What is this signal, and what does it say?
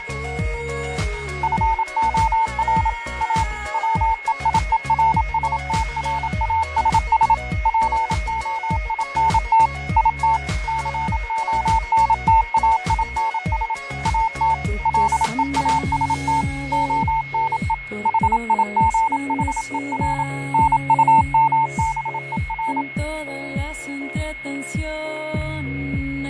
Morse code, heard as a keyed tone, machine-sent, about 27 wpm, 900 Hz, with fading and a steady whistle near 2170 Hz. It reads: FOR A WEIERSTRASS POINT IT CONTAINS AT LEAST ONE HIGHER NUMBER